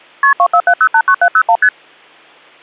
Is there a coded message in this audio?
Yes: multi-frequency trunk signalling (R1, as on North American trunks) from 0.2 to 1.7 s, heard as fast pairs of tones, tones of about 70 ms. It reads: KP 247089701 ST